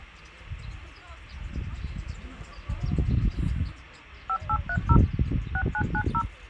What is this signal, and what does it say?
DTMF, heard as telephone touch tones, dialled by machine, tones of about 70 ms, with hum and the noise of a park. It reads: 5830 6990